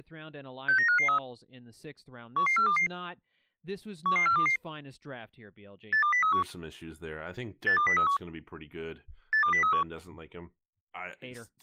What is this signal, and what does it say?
Five-tone selective call (CCIR), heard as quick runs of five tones, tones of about 100 ms, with speech in English. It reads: 69553 11422 11422 82031 82031 82031